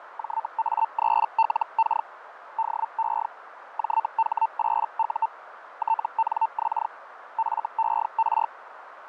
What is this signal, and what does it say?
Hellschreiber (Feld-Hell, 122.5 baud), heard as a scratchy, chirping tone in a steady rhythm, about 900 Hz, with radio static, fading and a narrow filter. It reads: JA3LK DE JH8U TNX FER